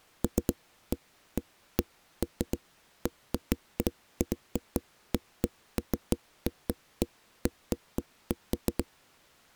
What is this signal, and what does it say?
Irregular knocks on a wall. There is no code.